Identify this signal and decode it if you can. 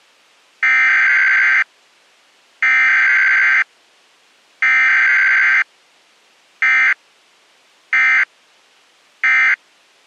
Emergency Alert System (SAME) tones (header bursts, then end-of-message bursts), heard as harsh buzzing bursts, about 520.83 baud.